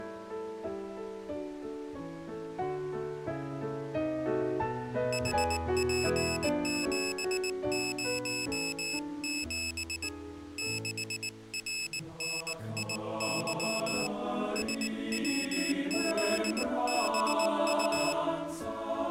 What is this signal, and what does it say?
Morse code, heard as a high beeper, hand-sent with a paddle, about 19 wpm, 2600 Hz. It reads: HP707 6RNIY SWZBU